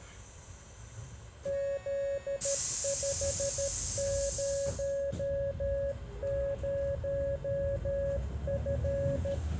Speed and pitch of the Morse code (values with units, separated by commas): 13 wpm, 560 Hz